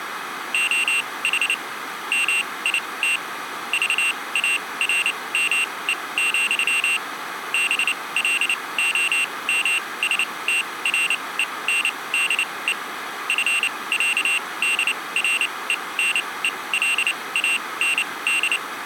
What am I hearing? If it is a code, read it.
Morse code (with Danish letters), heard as a high beeper, machine-sent, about 29 wpm, spaced as for 21 wpm, 2750 Hz. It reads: OH MIT VARME, BLOMSTRENDE FÆDRENELAND